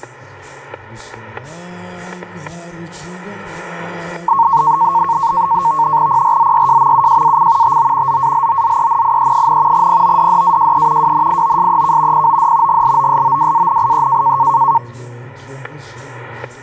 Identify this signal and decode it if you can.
NAVTEX (SITOR-B), 100 baud, 170 Hz shift, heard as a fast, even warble, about 1000 Hz centre, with static crashes. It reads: PRZYJMUJAC TO ZALOZENIE, PODDAJE WNIOSEK POD GLOSOWANIE